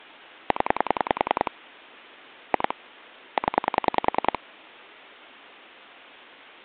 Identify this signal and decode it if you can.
Pulse dialling, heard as clicks on a phone line, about 10 pulses a second. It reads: 0 2 0